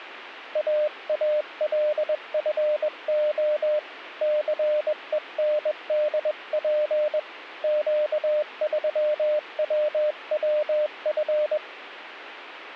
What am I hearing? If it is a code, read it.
Morse code, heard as a keyed tone, hand-sent with a bug key, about 21 wpm, 600 Hz. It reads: AALFO CENDP Q3WWF